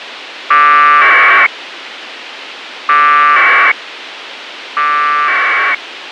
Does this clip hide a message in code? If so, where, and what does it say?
Yes: packet radio (AX.25, as in APRS), 1200 baud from 0.5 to 5.7 s, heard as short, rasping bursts, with radio hiss.